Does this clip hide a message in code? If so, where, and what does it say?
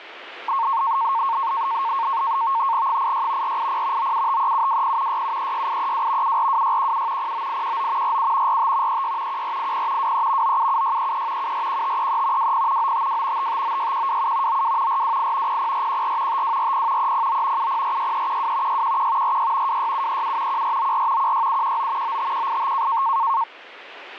Yes: NAVTEX (SITOR-B), 100 baud, 170 Hz shift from 0.5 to 23.4 s, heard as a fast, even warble, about 1000 Hz centre, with radio static. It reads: 86 480 9753720 6736832 742617 09819 47 45 36 1480 23 977633 741533 20 952 5596127 92 428 00414 5240 309 7046312 611 46 26737 1494 16719 95185